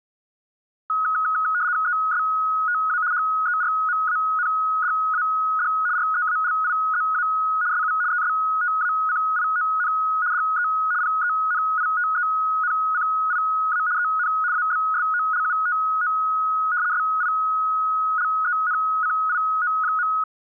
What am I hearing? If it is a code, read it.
RTTY (75 baud, 170 Hz shift), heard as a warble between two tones, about 1360 Hz centre. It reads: ESTA HERMANDAD REALIZA SU ESTACION DE PENITENCIA EN ABSOLUTO SILENCIO.